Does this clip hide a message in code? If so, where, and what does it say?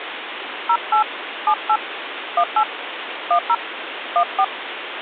Yes: DTMF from 0.7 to 4.4 s, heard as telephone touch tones, dialled by hand, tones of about 80 ms, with phone line noise. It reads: 08 78 18 10 14